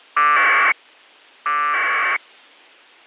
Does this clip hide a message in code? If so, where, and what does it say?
Yes: packet radio (AX.25, as in APRS), 1200 baud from 0.2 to 2.2 s, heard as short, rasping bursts.